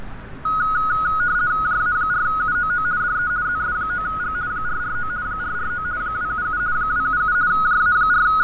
RTTY (50 baud, 170 Hz shift), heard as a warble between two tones, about 1360 Hz centre, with radio static, fading and street noise. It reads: JA4UOO DE ZS9G 449 449 277 277 …